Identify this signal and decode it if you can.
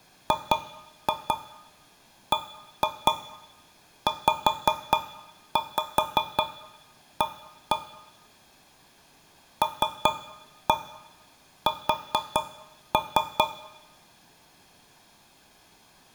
Tap code, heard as taps on a metal pipe, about 4 knocks a second, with room echo. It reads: GBZA LS